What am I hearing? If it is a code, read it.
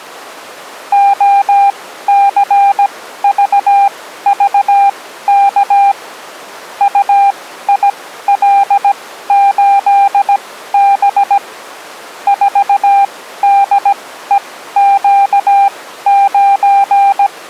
Morse code, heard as a keyed tone, machine-sent, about 17 wpm, spaced as for 13 wpm, 800 Hz. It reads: OCVVK UIL8B 4DEQ9